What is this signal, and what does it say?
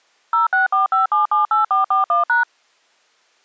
DTMF, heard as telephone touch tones, dialled by machine, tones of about 140 ms. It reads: 0645778441#